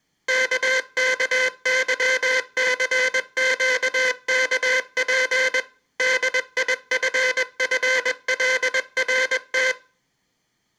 Morse code (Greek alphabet), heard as a buzzer, machine-sent, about 21 wpm, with room echo. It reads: ΚΚΥΘΨΚΠ ΔΙΦΦΛΡΤ